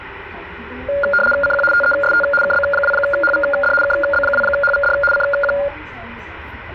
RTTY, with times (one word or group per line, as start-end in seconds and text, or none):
1.4-1.6 CQ
1.7-2.2 TEST
2.4-3.7 KB2HVD
3.8-4.9 KB2HVD
5.1-5.5 CQ